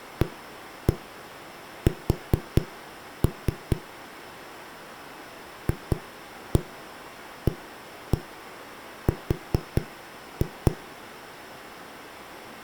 Tap code, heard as knocks on a wall, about 4 knocks a second, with room echo. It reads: AS FAR